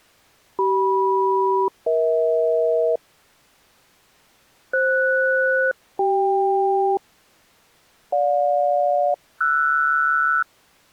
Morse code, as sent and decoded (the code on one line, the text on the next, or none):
none